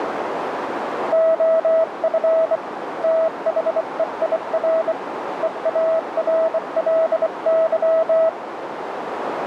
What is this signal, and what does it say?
Morse code, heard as a keyed tone, hand-sent with a bug key, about 24 wpm, 650 Hz, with radio static and a narrow filter. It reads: OF THEIR EARLY